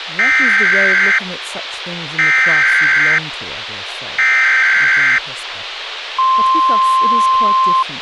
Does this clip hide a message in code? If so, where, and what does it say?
Yes: Emergency Alert System (SAME) tones (header bursts, then the 1050 Hz attention tone) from 0.2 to 7.8 s, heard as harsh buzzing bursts, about 520.83 baud, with radio hiss and speech in English.